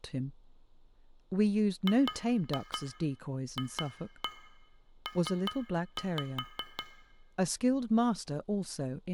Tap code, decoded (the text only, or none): GFP